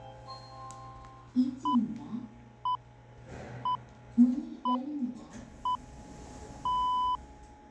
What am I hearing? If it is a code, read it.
Radio time signal (six pips, as the Greenwich Time Signal), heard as pips, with the noise inside a lift.